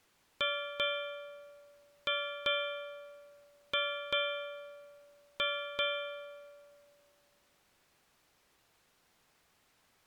Ship's bell, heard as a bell. 8. Eight half-hours of the watch have passed.